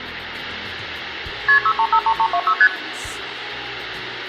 Multi-frequency trunk signalling (R1, as on North American trunks), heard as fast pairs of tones, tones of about 70 ms, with phone line noise. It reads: KP 6353326 ST